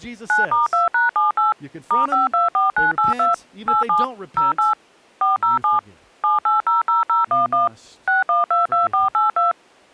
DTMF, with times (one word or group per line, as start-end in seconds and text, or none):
0.3-1.5 9*2#78
1.9-3.3 *524982
3.7-4.0 87
4.4-4.7 08
5.2-5.8 407
6.2-7.7 7800011
8.1-9.5 6122482